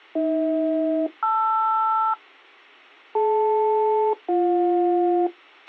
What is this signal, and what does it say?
Aircraft SELCAL, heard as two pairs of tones, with a squelch burst at the end. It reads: AH-LR DL-BJ